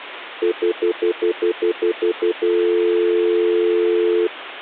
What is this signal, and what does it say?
Telephone call progress tone (North American plan), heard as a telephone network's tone, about 350, 440 Hz, 0.1 s on and 0.1 s off. Stutter dial tone.